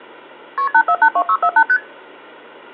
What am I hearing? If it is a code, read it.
Multi-frequency trunk signalling (R1, as on North American trunks), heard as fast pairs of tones, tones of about 70 ms, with hum. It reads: KP 8482648 ST